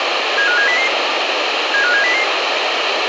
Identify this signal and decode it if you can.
Five-tone selective call (CCIR), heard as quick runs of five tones, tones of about 100 ms, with radio hiss. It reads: 75700 75700